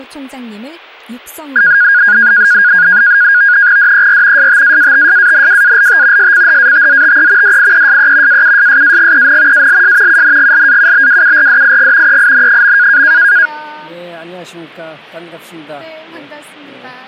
NAVTEX (SITOR-B), 100 baud, 170 Hz shift, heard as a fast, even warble, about 1550 Hz centre. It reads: DER STAATSANWALT SCHATZTE DIESE AUSSAGEN ALS UNGLAUBWURDIG EIN.